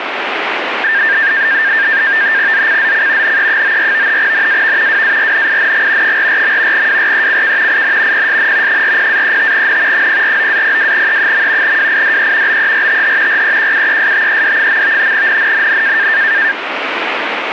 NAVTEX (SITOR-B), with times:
2.5-3.4 ZCZC
3.2-4.2 NE94
4.2-5.0 NAV
4.9-6.2 WARNING
6.0-6.9 44.
6.7-7.8 WRECK
7.7-8.3 IN
8.1-8.8 PSN
8.7-10.1 40-35N
9.9-11.8 049-02E.
11.6-12.6 WIDE
12.5-13.4 BERTH
13.3-15.1 REQUESTED.
15.1-16.1 NNNN

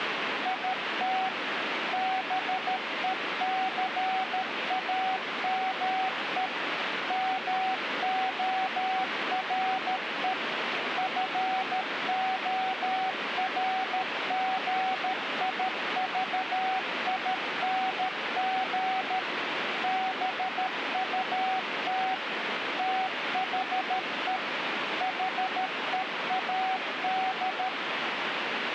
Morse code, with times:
0.5-1.3 IT
1.9-6.5 BECAME
7.1-10.3 MORE
11.0-19.2 FORGIVING
19.8-22.1 BUT
22.8-24.4 THE
25.0-27.7 HEAD

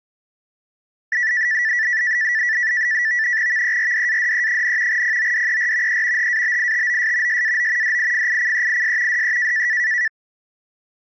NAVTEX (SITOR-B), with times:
3.5-5.0 VERDADE,
4.9-6.0 PODER
5.9-6.3 E
6.2-7.4 HABITOS
7.3-8.0 SAO
7.8-9.2 DIFICEIS
9.1-9.7 DE

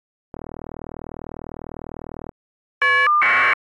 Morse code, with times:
none

